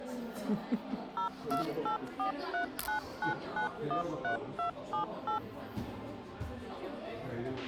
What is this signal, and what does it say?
DTMF, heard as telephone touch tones, dialled by machine, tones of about 110 ms, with a squelch burst at the end and the noise of a crowd indoors. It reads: 0284399913278